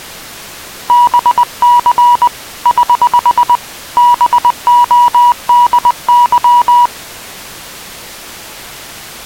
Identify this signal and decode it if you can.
Morse code, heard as a keyed tone, hand-sent with a paddle, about 20 wpm, 970 Hz. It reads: BC <HH> BODY